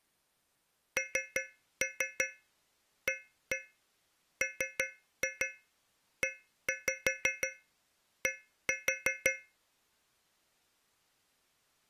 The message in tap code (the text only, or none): NAMED